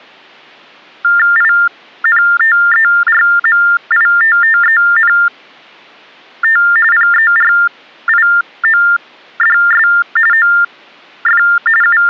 TTY/TDD text telephone tones (45.45 baud Baudot), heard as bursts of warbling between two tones, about 400 Hz shift, 1600 Hz centre. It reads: INTERMITTENT PERIODS OF …